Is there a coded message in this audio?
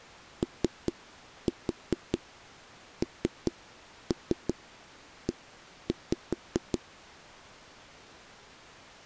Yes: tap code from 0.4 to 6.8 s, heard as knocks on a wall, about 5 knocks a second. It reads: ONE